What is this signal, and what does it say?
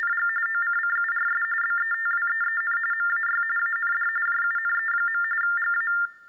TTY/TDD text telephone tones (45.45 baud Baudot), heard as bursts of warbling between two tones, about 400 Hz shift, 1600 Hz centre. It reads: … OCCURS BETWEEN MAY AND JUNE. GA